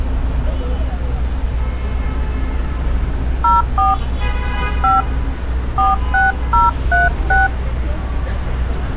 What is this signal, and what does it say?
DTMF, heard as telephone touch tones, dialled by hand, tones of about 170 ms, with street noise. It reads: 04 5 46036